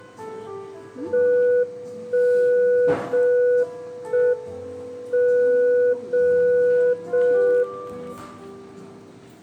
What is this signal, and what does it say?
Radio time signal (JJY), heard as a tone whose level steps once a second, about 490 Hz, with the noise of a cafe. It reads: 1 0 1 M 0 0 1